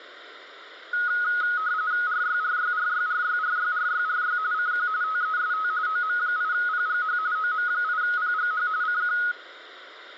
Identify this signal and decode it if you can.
RTTY (45.45 baud, 170 Hz shift), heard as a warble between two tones, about 1360 Hz centre, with radio static. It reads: RYRYRYRYRYRYRY CQ TEST OM8PGH OM8PGH CQ